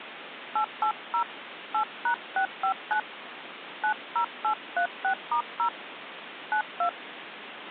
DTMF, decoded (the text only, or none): 880 8#659 90836*0 92